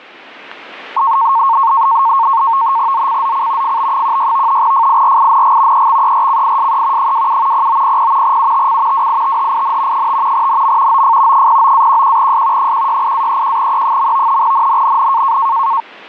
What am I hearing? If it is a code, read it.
NAVTEX (SITOR-B), 100 baud, 170 Hz shift, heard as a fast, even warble, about 1000 Hz centre. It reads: ZCZC FB16 FIRING EXERCISE 27 0900 UTC WITHIN 5 NM OF 09-11S 168-31E. NNNN